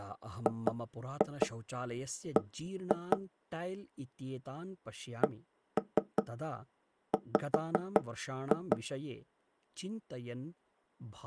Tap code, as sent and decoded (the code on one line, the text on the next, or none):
2-2 1-2 / 1-3 5-2
GB CW